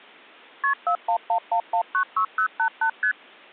Multi-frequency trunk signalling (R1, as on North American trunks), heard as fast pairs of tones, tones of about 90 ms. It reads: KP 4111196088 ST